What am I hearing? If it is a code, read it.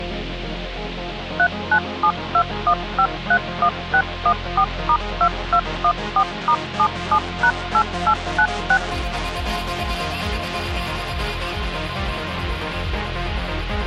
DTMF, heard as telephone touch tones, dialled by machine, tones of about 70 ms. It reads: 39721531614*2214*77#8896